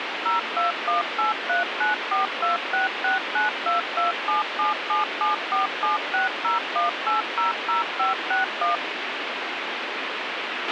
DTMF, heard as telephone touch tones, dialled by machine, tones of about 140 ms, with radio hiss and a squelch burst at the end. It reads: 0218394266922777747601800561